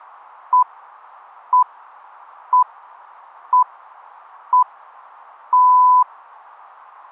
Radio time signal (six pips, as the Greenwich Time Signal), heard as pips.